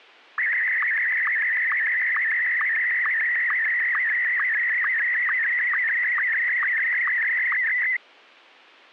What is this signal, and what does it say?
SSTV (slow-scan television), Martin M1, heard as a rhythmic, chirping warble.